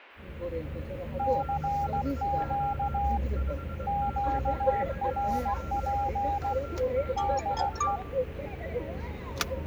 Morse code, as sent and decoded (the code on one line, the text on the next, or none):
-.-. --.- / --.- .-. .--. / -.. .
CQ QRP DE